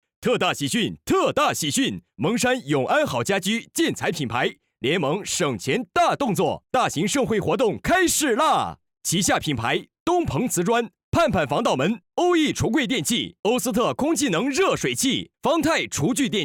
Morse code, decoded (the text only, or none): none